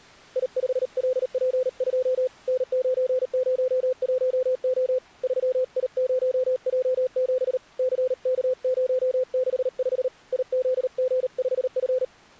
Morse code, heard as a keyed tone, hand-sent with a paddle, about 38 wpm, 510 Hz. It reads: I5LP2 N901O 3I0J7 CK065 IZG5F